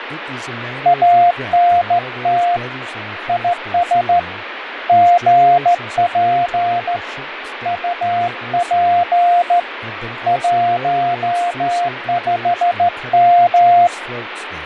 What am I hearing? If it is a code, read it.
Morse code, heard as a keyed tone, hand-sent with a straight key, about 14 wpm, 700 Hz, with radio static, fading and speech in English. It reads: ANT IS GP UP 15M